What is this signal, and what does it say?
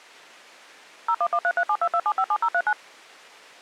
DTMF, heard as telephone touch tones, dialled by machine, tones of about 60 ms. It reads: 01133722757039